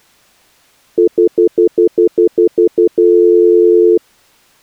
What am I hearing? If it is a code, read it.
Telephone call progress tone (North American plan), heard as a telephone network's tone, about 350, 440 Hz, 0.1 s on and 0.1 s off. Stutter dial tone.